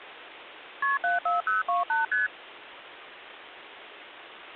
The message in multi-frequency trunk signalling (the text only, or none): KP 74028 ST